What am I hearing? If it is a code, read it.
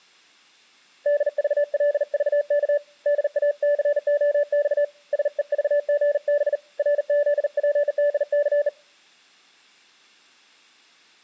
Morse code, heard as a keyed tone, hand-sent with a bug key, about 39 wpm, 580 Hz. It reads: DVLVK DACOX SEVGB RZPDC